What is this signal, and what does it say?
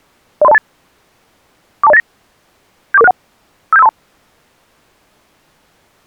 Five-tone selective call (EIA), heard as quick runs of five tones, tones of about 30 ms. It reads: 03028 42089 74461 57532